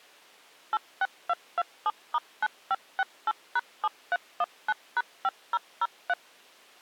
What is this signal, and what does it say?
DTMF, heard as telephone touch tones, dialled by machine, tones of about 40 ms. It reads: 86227*9568#7319#5003